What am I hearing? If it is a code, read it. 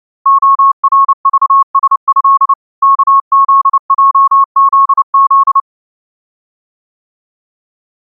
Morse code (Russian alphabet), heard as a keyed tone, machine-sent, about 29 wpm, 1100 Hz. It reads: ОРЖСЭ КЗЙЗЗ